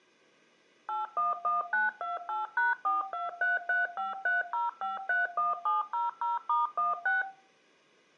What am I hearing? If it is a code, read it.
DTMF, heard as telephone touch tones, dialled by machine, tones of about 160 ms, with room echo. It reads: 811928#4233530531700*16